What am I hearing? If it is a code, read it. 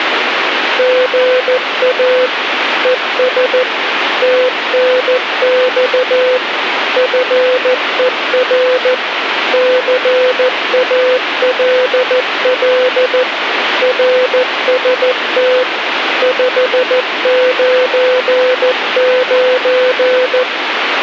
Morse code, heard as a keyed tone, machine-sent, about 14 wpm, 510 Hz, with radio static. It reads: GA ES TNX FER CALL RST 599